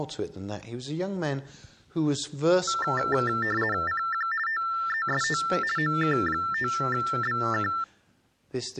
RTTY (50 baud, 450 Hz shift), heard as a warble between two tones, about 1550 Hz centre. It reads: CQ TEST OK5BK